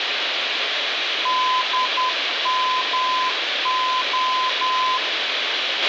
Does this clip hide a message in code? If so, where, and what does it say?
Yes: Morse code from 1.2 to 5.0 s, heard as a keyed tone, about 10 wpm, 1020 Hz, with radio hiss, a squelch burst at the end and room echo. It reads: DMO